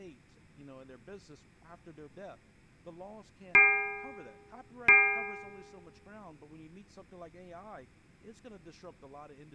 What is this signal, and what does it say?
Clock strike, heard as a bell, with room echo and speech in English. 2. Two o'clock.